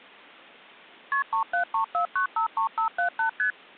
Multi-frequency trunk signalling (R1, as on North American trunks), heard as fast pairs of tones, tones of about 100 ms. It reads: KP 3734953578 ST